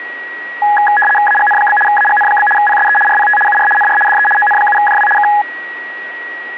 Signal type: RTTY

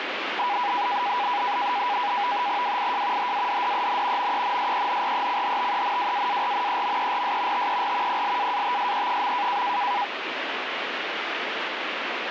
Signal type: NAVTEX (SITOR-B)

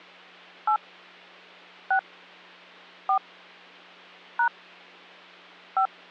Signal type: DTMF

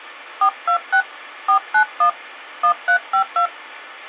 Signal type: DTMF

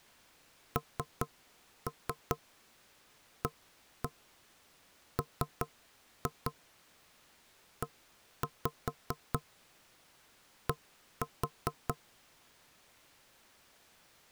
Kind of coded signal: tap code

